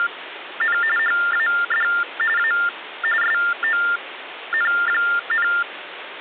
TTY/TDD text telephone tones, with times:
0.0-0.8 …
1.0-1.9 HAD
2.4-2.5 A
3.2-5.5 SON,

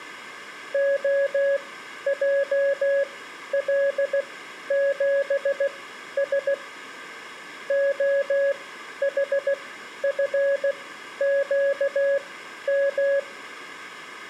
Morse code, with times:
0.7-6.5 OJL7S
7.7-13.2 OHFQM

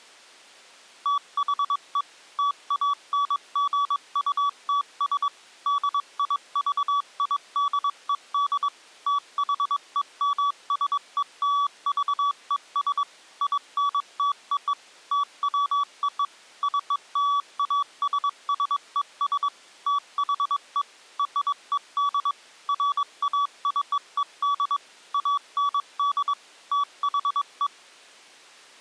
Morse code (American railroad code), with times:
1.1-2.0 THE
2.4-5.3 TANGUTS
5.7-8.7 DIVIDED
9.1-13.0 THEMSELVES
13.4-14.7 INTO
15.1-16.2 TWO
16.6-19.5 CLASSES
19.9-20.8 THE
21.2-22.3 RED
22.7-24.8 FACED
25.1-26.3 AND
26.7-27.7 THE

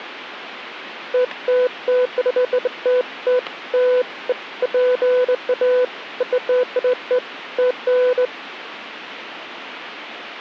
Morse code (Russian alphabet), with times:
none

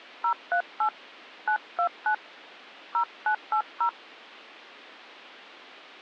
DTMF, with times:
0.2-0.9 038
1.5-2.1 929
2.9-3.9 0980

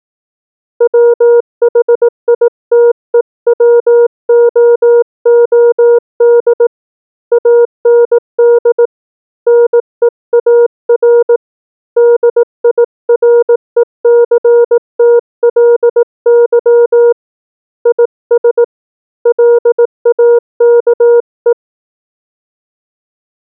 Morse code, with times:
0.8-6.7 WHITEWOOD
7.3-8.9 AND
9.5-11.4 NEAR
12.0-17.1 DIRECTLY
17.9-18.6 IS
19.3-21.5 LAKE

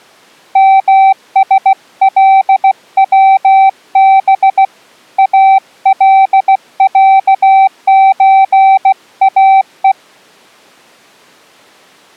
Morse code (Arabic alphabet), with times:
0.6-4.6 مسلوب
5.2-9.9 العزاء

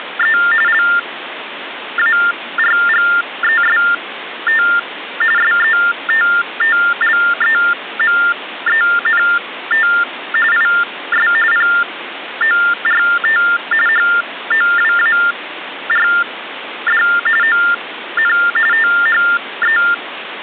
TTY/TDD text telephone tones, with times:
0.0-0.4 …
0.7-4.6 LARGEST
5.4-9.9 SETTLEMENT
10.5-11.3 IS
11.5-13.4 PORT
13.9-17.0 HOWARD
17.4-18.3 ON
18.7-19.8 THE

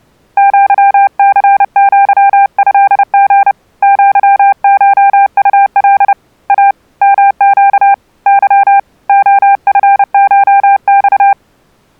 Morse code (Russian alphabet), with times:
0.4-3.5 ЪЦЪЭГ
3.8-6.1 ЪШУЛ
6.5-6.7 А
7.0-7.9 МЩ
8.3-8.8 Ы
9.1-11.3 ОФШЬ

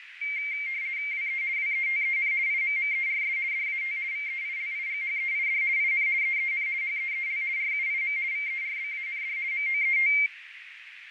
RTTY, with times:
1.1-1.4 WE
1.6-2.3 WETEN
2.5-3.4 IMMERS
3.5-4.0 DAT
4.1-5.6 VEILIGHEID
5.8-6.1 IN
6.2-6.7 EEN
6.8-7.4 HEEL
7.6-8.2 RUIM
8.3-9.4 VERBAND
9.5-10.1 MOET

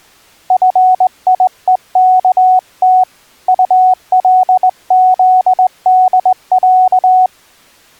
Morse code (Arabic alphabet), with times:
0.5-3.0 فيءكت
3.5-7.3 طلذدع

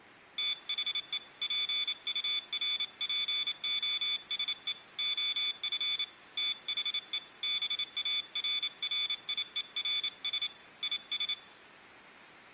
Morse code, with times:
0.4-1.2 THE
1.4-4.7 PURPOSE
5.0-6.0 OF
6.4-7.2 THE
7.4-10.5 BARRIERS
10.8-11.3 IS

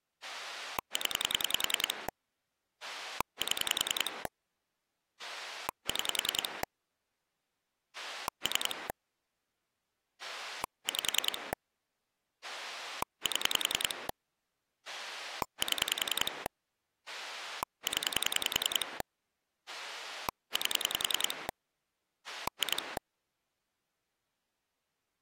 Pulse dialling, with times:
0.2-2.1 0
2.8-4.3 7
5.2-6.6 6
7.9-8.9 3
10.2-11.5 5
12.4-14.1 7
14.9-16.5 7
17.1-19.0 0
19.7-21.5 8
22.3-23.0 2

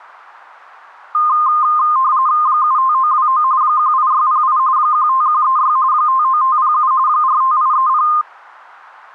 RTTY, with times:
2.5-3.4 75929
3.6-4.6 18608
4.8-5.8 15136
5.9-6.9 59507
7.1-8.1 45830

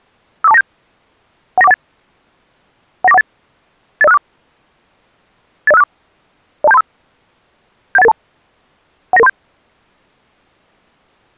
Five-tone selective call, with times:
0.4-0.6 54297
1.6-1.7 19418
3.0-3.2 19418
4.0-4.2 80564
5.7-5.8 80564
6.6-6.8 02735
8.0-8.1 71882
9.1-9.3 19937

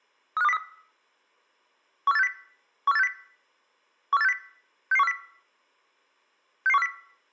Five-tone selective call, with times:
0.4-0.6 35203
2.1-2.3 14860
2.9-3.1 14860
4.1-4.3 14860
4.9-5.1 66140
6.7-6.9 66140

